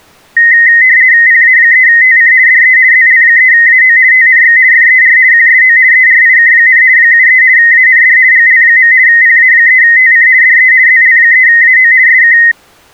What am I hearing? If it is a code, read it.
RTTY (50 baud, 170 Hz shift), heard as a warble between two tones, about 1950 Hz centre. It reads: PA3TC DE ZL3AO TNX FER QSO ERIK, 73 AND GL. PA3TC DE ZL3AO SK